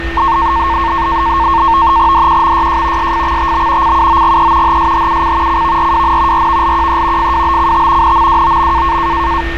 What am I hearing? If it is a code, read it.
NAVTEX (SITOR-B), 100 baud, 170 Hz shift, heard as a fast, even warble, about 1000 Hz centre, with radio static, a steady whistle near 1820 Hz and street noise. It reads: DQMYJ SFXTB CUOGE HSHUC CVRWN RVLQE FWBCT NMWOM